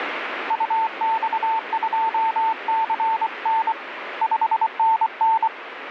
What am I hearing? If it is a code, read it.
Morse code, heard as a keyed tone, hand-sent with a paddle, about 24 wpm, 890 Hz, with radio static. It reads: UX2CN 5NN